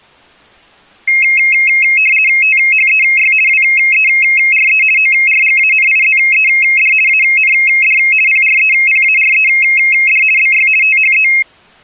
RTTY (50 baud, 450 Hz shift), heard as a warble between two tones, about 2350 Hz centre. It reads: THEY WERE ORGANIZED AND PREPARED BY THE